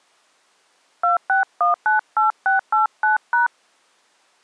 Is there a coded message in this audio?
Yes: DTMF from 1.0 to 3.5 s, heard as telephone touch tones, dialled by hand, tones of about 140 ms. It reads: 26198689#